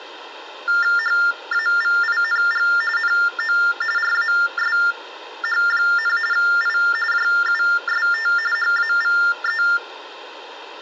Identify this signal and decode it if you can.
TTY/TDD text telephone tones (45.45 baud Baudot), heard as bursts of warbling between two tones, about 400 Hz shift, 1600 Hz centre, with room echo. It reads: HAVING NO RASH, I JUST HAVE